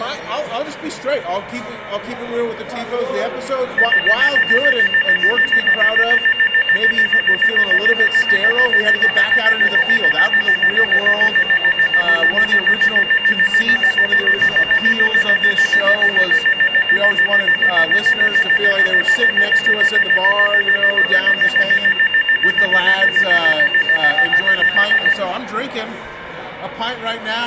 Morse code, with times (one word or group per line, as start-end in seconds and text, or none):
none